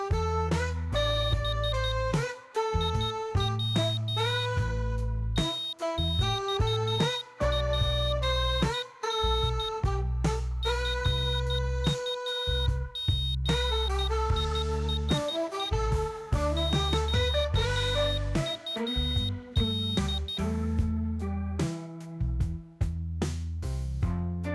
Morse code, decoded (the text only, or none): B IW TXPN FUGISE QUD